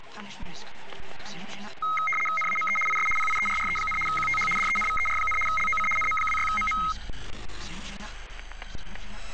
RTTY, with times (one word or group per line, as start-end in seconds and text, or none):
2.4-2.8 NAME
2.9-3.1 IS
3.2-4.0 PIERRE,
4.1-4.5 QTH
4.6-5.4 DENVER,
5.5-5.9 LOC
6.0-6.8 NM26MM